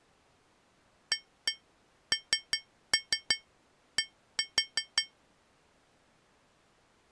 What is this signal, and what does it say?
Tap code, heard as taps on glass, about 5 knocks a second. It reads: AND